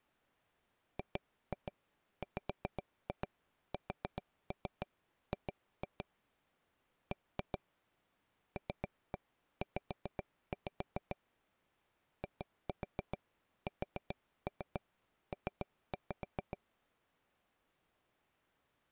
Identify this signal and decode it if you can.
Tap code, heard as taps on a table, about 7 knocks a second. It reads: GWSG B LZ ISP